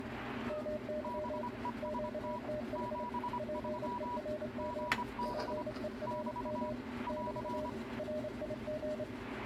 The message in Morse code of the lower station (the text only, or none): MY QTH PERM PERM <BT> RIG